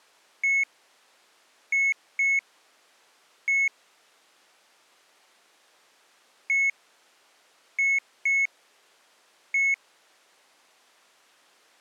Beep code, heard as beeps, played twice, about 2200 Hz. 1-2-1. In Phoenix BIOS tables: interval timer failure.